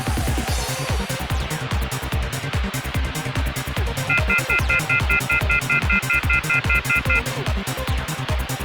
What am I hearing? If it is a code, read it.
Telephone call progress tone (North American plan), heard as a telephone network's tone, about 1400, 2050, 2450, 2600 Hz, 0.1 s on and 0.1 s off, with phone line noise. Off-hook warning tone.